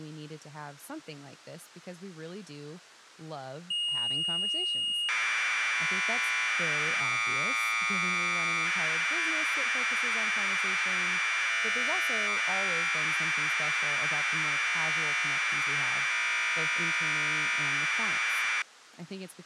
Commodore tape loading (standard loader), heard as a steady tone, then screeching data, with speech in English.